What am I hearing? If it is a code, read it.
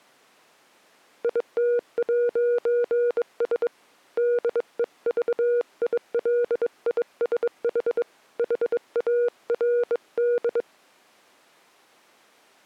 Morse code, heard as a keyed tone, hand-sent with a bug key, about 22 wpm, 480 Hz. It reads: IT'S DEVILISH HARD